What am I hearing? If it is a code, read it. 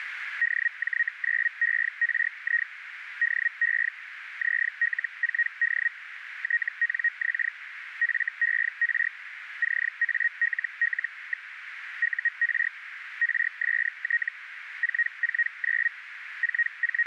Hellschreiber (Feld-Hell, 122.5 baud), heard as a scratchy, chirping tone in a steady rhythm, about 1900 Hz, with radio static and a narrow filter. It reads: DJ9ERI DE ZL4D TNX FER CALL. UR RST 449 …